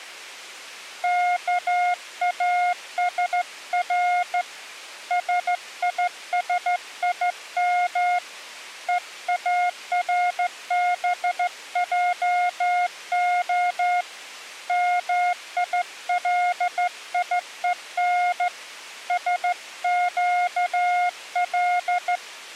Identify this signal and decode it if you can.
Morse code (Hebrew alphabet), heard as a keyed tone, hand-sent with a straight key, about 14 wpm, 710 Hz. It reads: כאשר שישים וארבעה מיליון שקל